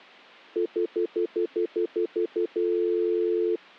Telephone call progress tone (North American plan), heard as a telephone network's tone, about 350, 440 Hz, 0.1 s on and 0.1 s off. Stutter dial tone.